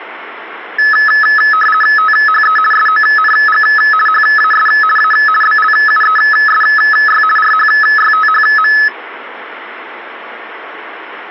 RTTY (50 baud, 450 Hz shift), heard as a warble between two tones, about 1500 Hz centre. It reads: THE SONG HAS A BLUESY RHYTHM